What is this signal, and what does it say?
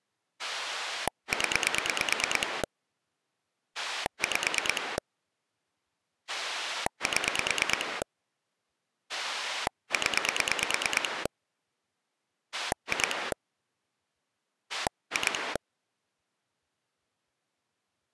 Pulse dialling, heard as a rotary dial, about 9 pulses a second. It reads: 0 5 7 0 2 2